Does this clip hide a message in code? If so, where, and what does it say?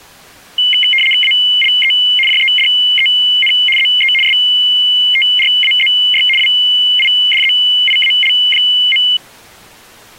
Yes: RTTY (75 baud, 850 Hz shift) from 0.6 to 9.2 s, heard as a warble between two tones, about 2550 Hz centre. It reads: ALE JEDEN ZE STRAZY WIDZIAL.